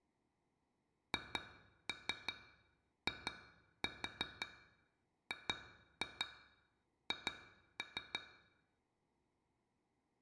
Tap code, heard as taps on glass, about 5 knocks a second, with room echo. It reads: HIGH